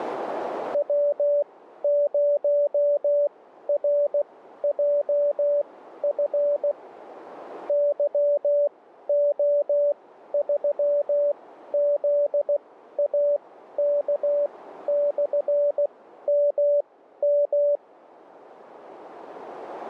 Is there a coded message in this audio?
Yes: Morse code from 0.7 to 17.8 s, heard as a keyed tone, machine-sent, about 16 wpm, spaced as for 12 wpm, 580 Hz, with radio static. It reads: W0RJF YO3ZAK/MM